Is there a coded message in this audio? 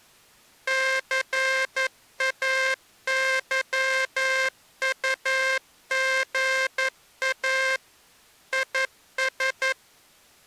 Yes: Morse code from 0.6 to 9.8 s, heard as a buzzer, machine-sent, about 11 wpm. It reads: CAYUGA IS